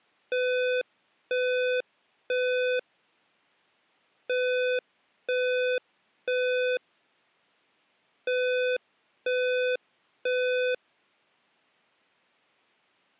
Alarm pattern, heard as an alarm's beeps, played three times, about 500 Hz. Temporal three. Smoke or fire, evacuate.